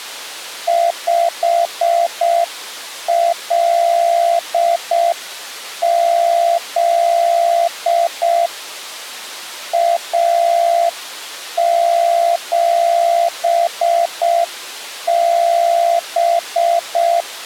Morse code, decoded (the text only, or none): 5LZ A7B